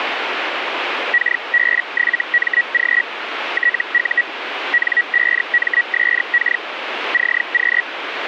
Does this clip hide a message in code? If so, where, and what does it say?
Yes: Hellschreiber (Feld-Hell, 122.5 baud) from 1.1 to 7.8 s, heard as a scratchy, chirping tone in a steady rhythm, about 1900 Hz, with radio static. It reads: KB7MG TU N5MSK CQ